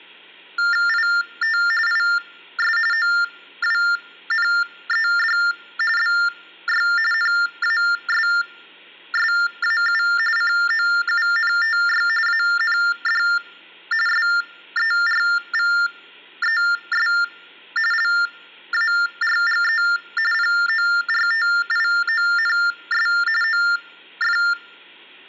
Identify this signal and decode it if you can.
TTY/TDD text telephone tones (45.45 baud Baudot), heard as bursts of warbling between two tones, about 400 Hz shift, 1600 Hz centre. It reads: IT IS OWNED BY NASSAU COUNTY AND SERVES LARGE PORTIONS OF